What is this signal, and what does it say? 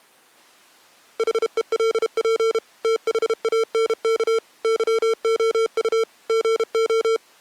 Morse code, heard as electronic beeps, machine-sent, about 32 wpm, 450 Hz. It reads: HELP THANK YOU GO